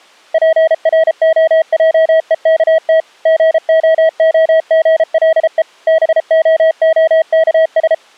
Morse code, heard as a keyed tone, machine-sent, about 33 wpm, 640 Hz. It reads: PROJEKT GOOGLE BOOKS